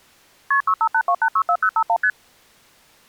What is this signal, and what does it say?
Multi-frequency trunk signalling (R1, as on North American trunks), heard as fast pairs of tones, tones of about 70 ms. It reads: KP 6582864051 ST